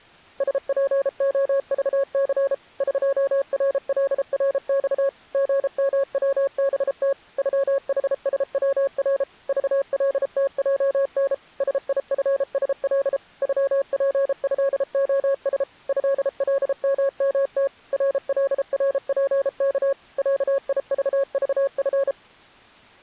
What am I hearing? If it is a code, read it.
Morse code (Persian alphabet), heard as a keyed tone, machine-sent, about 33 wpm, 550 Hz. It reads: سپعذث قرلرخ ژموبت غحسور ذلتجن سیفسل غپضعس ضلممت رلرپک صیذذف